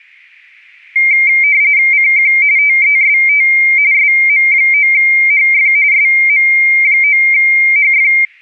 RTTY (45.45 baud, 170 Hz shift), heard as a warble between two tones, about 2200 Hz centre. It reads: CQ TEST SM9HF SM9HF